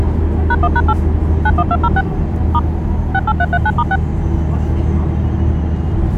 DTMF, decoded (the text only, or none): #1#8 91206 * 68339*6